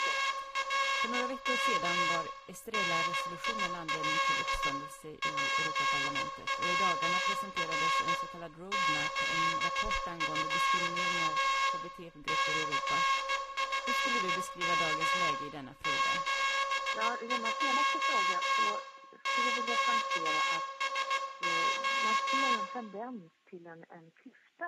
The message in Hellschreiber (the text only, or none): none